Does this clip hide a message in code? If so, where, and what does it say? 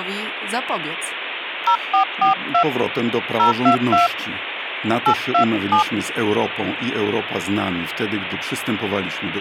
Yes: DTMF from 1.7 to 5.8 s, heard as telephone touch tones, dialled by hand, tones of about 100 ms, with phone line noise and speech in Polish. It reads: 0442 022 827